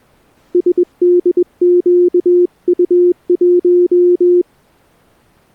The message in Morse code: SDQU1

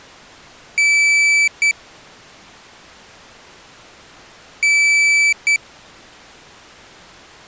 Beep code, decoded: 1 long, 1 short

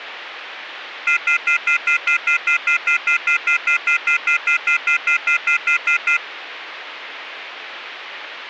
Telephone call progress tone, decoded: off-hook warning tone

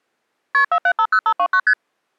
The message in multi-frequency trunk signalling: KP 4750529 ST

